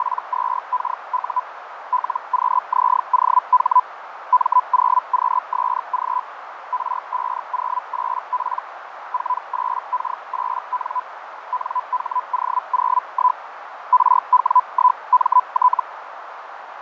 Hellschreiber (Feld-Hell, 122.5 baud), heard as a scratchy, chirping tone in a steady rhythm, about 1000 Hz, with radio static, fading and a narrow filter. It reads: … LQZOH M0QSG R508P 48K8N NHO01 RW1MT